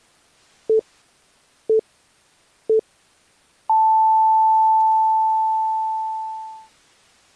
Radio time signal (three low pips and a long one an octave up, as on NHK), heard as pips.